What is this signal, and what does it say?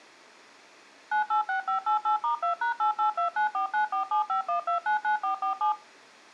DTMF, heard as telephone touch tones, dialled by machine, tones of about 120 ms. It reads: 986588*2#8829494751299447